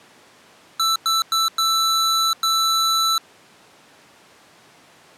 Beep code, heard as beeps from a small speaker, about 1320 Hz. 3 short, 2 long.